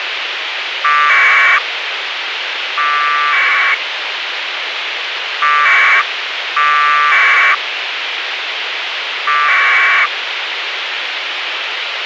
Packet radio (AX.25, as in APRS), 1200 baud, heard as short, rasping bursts, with radio hiss.